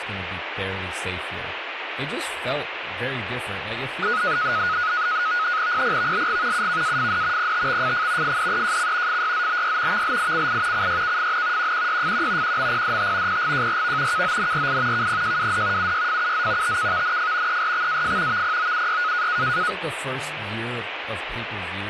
NAVTEX (SITOR-B), 100 baud, 170 Hz shift, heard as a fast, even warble, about 1360 Hz centre, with radio static and speech in English. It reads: PPVLG UKAFD PTXFF FDEJC FYZBY VLICI CYKFN QQYFQ QMPDT PGJRV KONRI KPJWD UYFUZ TKVNF ERXAF VPOUY